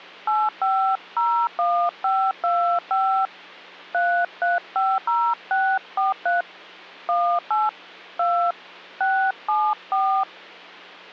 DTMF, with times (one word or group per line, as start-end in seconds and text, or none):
0.3-3.3 8501525
3.9-6.4 3350643
7.1-7.7 18
8.2-8.5 2
9.0-10.2 674